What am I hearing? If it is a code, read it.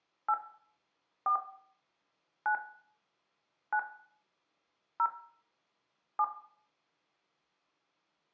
DTMF, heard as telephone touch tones, dialled by hand, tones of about 80 ms, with room echo. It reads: 8 4 9 9 0 7